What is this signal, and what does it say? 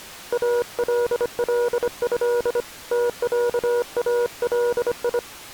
Morse code (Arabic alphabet), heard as a keyed tone, hand-sent with a bug key, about 25 wpm, 480 Hz. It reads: الله تعالي